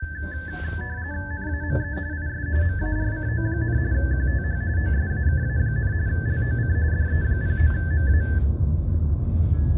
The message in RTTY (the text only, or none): NAME IS MARCO, QTH OSAKA, LOC DE09MA